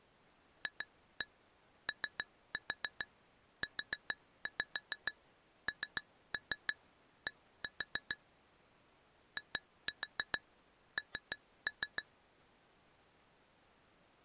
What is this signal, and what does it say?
Tap code, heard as taps on glass, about 6 knocks a second. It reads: FOUND IN